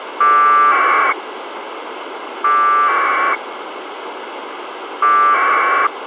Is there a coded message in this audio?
Yes: packet radio (AX.25, as in APRS), 1200 baud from 0.2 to 5.9 s, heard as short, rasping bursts, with radio hiss.